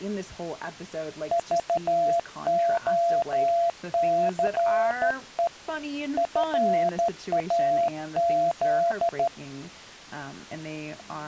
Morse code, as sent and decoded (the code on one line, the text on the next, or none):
...- --- -.-. . / ..-. .- --..
VOCE FAZ